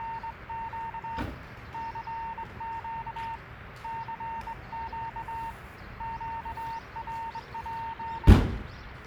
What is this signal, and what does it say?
Morse code, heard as a keyed tone, hand-sent with a straight key, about 22 wpm, 910 Hz, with radio static, a weaker station near 390 Hz and the noise of a residential street. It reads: … CQ CQ QRP